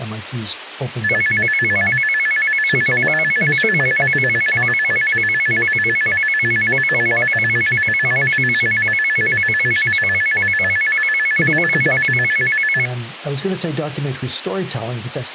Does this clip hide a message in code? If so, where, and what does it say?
No, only a tone that alternates evenly between two pitches.